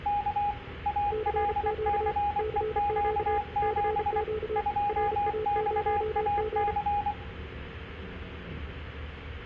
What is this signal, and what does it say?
Morse code, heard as two keyed tones, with room echo and the noise inside a bus. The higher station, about 24 wpm, 820 Hz: K ALCEQ7 2XAC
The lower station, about 34 wpm, 430 Hz: CQ CQ CQ RA0G